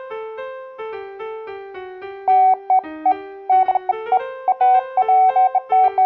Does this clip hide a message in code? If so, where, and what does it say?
No, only beeps of irregular length.